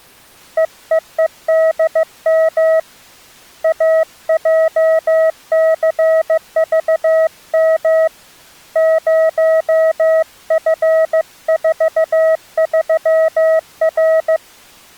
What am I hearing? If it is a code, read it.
Morse code, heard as a keyed tone, hand-sent with a paddle, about 15 wpm, 640 Hz. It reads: EEEDM AJCVM 0F43R